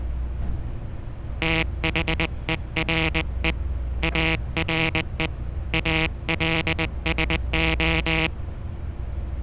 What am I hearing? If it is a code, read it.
Morse code, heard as a buzzer, hand-sent with a paddle, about 20 wpm, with street noise. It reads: THERE ARE ALSO